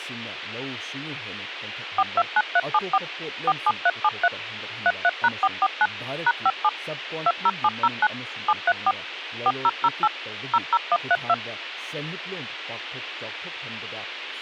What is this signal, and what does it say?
DTMF, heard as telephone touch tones, dialled by machine, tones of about 50 ms, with speech in Manipuri. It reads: 429374 47373 33#449 #57 20709 734 4008 00132